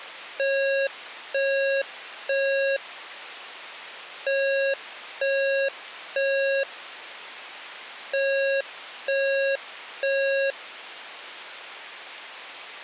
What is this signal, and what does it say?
Alarm pattern, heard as an alarm's beeps, played three times, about 550 Hz. Temporal three. Smoke or fire, evacuate.